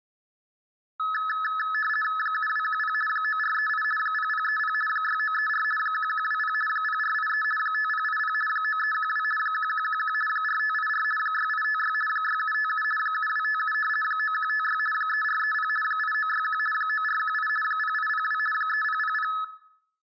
RTTY (50 baud, 450 Hz shift), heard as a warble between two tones, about 1500 Hz centre. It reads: 7210 9438 0030 6934 1120 0483 5080 9312 1111 4584 6856 6757 7257 9156 3430 8961 9418 0802 3000